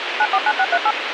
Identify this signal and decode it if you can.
DTMF, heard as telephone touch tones, dialled by machine, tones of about 60 ms, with radio hiss. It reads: 949638